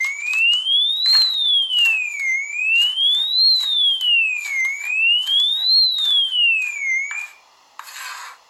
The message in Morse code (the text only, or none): none